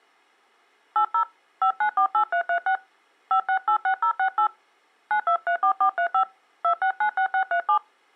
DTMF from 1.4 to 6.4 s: 5948336 5686068 9234435

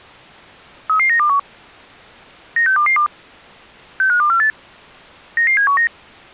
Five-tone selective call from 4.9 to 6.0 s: 99719

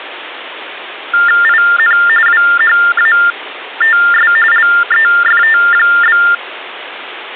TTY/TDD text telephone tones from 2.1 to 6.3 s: WHATS LEFT?

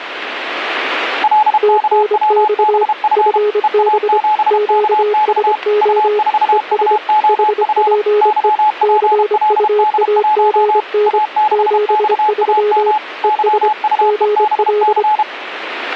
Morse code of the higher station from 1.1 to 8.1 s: LKWBF EA7KX U4UOF

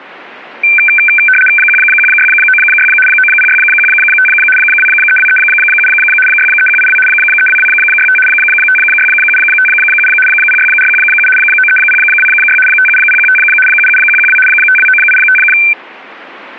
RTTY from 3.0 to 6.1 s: 90615 23237

